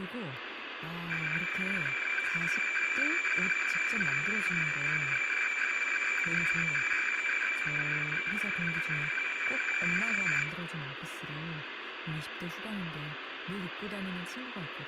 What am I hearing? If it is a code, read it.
Weather fax (radiofax), 120 lines a minute, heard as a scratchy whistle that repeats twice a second, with radio static, room echo and speech in Korean.